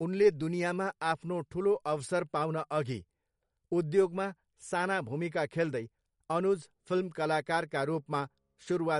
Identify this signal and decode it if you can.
Speech in Nepali. There is no code.